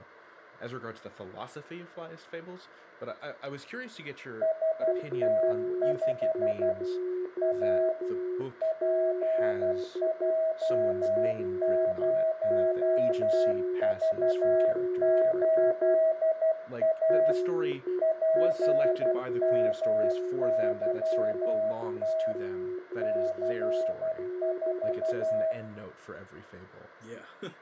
Morse code, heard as two keyed tones, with room echo and speech in English. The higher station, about 12 wpm, 640 Hz: ST5 A PJ0V8A PMYT C4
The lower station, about 10 wpm, 360 Hz: U2ZCK7 R46EXB